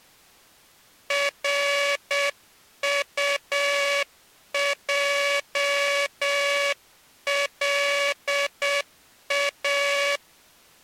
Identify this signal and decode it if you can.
Morse code, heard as a buzzer, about 7 wpm. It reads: RUJLA